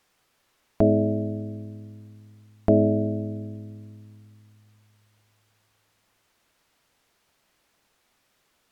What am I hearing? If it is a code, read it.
Clock strike, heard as a bell. 2. Two o'clock.